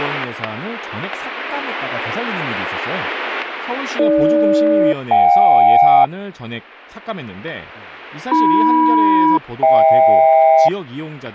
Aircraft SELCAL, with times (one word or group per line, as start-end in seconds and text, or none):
4.0-6.0 AG-JK
8.3-10.7 AM-HK